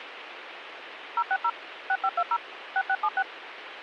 DTMF, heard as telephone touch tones, dialled by machine, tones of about 60 ms, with radio hiss. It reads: 060 6520 6676